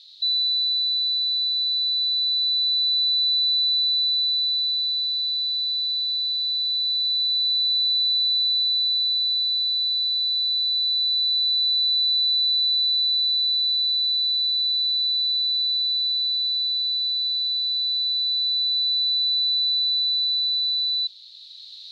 A steady tone, with radio static. There is no code.